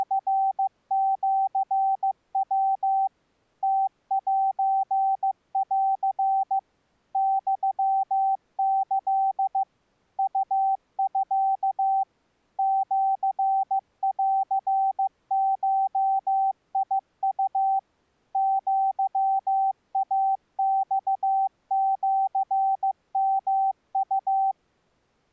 Morse code (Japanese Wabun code), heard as a keyed tone, machine-sent, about 15 wpm, 780 Hz. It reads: … ムセン ユキ ウミ シンゴウ アイマシヨウ